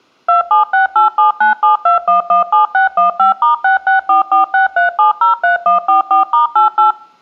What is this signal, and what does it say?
DTMF, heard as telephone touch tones, dialled by machine, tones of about 130 ms. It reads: 27687972117615*664463703144*88